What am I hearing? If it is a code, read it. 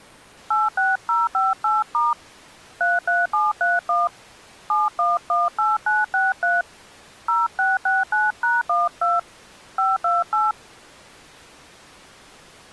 DTMF, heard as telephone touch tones, dialled by hand, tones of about 180 ms. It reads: 86058* 33731 7118963 0669#12 528